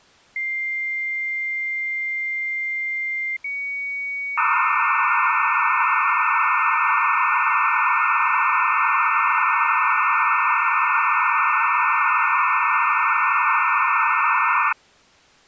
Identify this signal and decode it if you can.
Dial-up modem handshake (low-speed, two carriers), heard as two whistles, then hiss.